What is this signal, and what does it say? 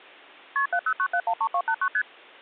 Multi-frequency trunk signalling (R1, as on North American trunks), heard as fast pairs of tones, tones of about 70 ms. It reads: KP 709713289 ST